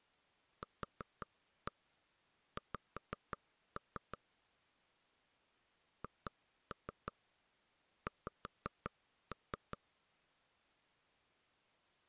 Tap code, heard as taps on a table, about 5 knocks a second. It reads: QX HX